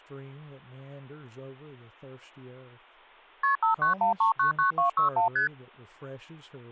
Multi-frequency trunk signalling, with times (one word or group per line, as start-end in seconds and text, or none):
3.4-3.6 KP
3.6-5.3 591399261
5.4-5.5 ST